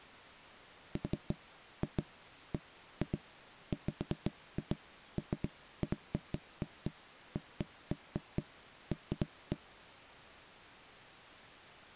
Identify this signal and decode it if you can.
Irregular knocks on wood. There is no code.